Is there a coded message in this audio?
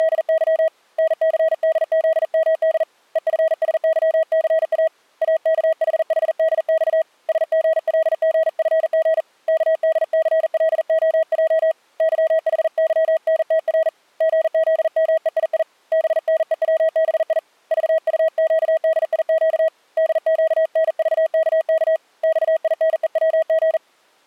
Yes: Morse code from 0.0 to 23.8 s, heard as a keyed tone, hand-sent with a paddle, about 40 wpm, 640 Hz. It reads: … NCDZMD EFSYCA AKHHDX SGLGFG KDCLOJ YHYNTR GZMEII BNEWBI VUQDIQ DQNVKK XINEWG